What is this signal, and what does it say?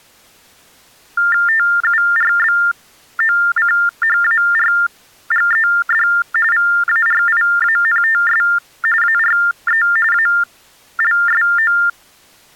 TTY/TDD text telephone tones (45.45 baud Baudot), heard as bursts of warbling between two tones, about 400 Hz shift, 1600 Hz centre. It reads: TURBOCHARGED VARIANTS ARE ALSO